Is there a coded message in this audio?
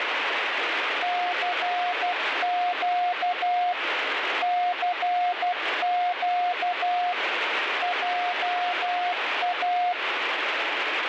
Yes: Morse code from 1.0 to 10.0 s, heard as a keyed tone, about 12 wpm, 720 Hz, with radio static. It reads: CQ CQ JA